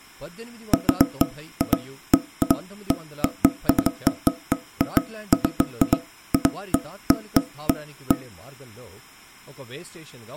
Irregular knocks on wood, with speech in Telugu. There is no code.